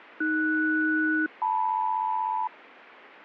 Aircraft SELCAL, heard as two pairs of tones, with radio static. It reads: AS-LM